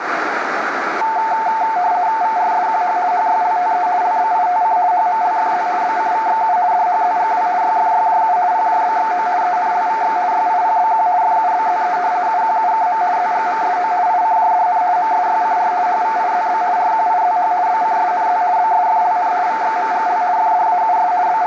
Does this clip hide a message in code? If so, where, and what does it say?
Yes: RTTY (50 baud, 170 Hz shift) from 1.0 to 21.5 s, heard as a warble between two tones, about 800 Hz centre, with radio static and a narrow filter. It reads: VRSQH HYLTE LBITC HMLFZ BCVXU DHZGW YFYJU PJBXO ENLVX YIPBQ FUBZE UQUKM ZGMSO ICJDN MSYCR HVIZB RQIZH BCSNZ BSFLN VXMGL FDAUS …